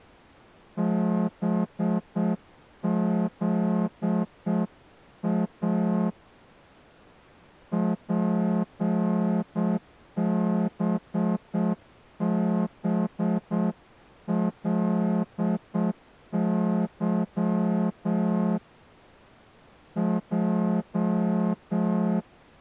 Morse code, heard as a horn, hand-sent with a straight key, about 7 wpm. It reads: BZA PBBLY J